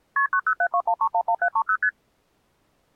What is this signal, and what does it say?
Multi-frequency trunk signalling (R1, as on North American trunks), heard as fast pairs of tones, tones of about 70 ms. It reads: KP 90721311730 ST